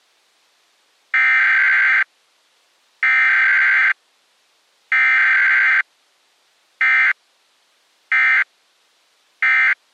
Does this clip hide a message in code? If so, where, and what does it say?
Yes: Emergency Alert System (SAME) tones (header bursts, then end-of-message bursts) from 1.1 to 9.7 s, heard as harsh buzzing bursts, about 520.83 baud.